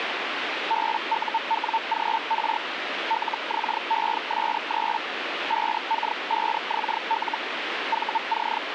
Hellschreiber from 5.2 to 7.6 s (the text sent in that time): 5K5XL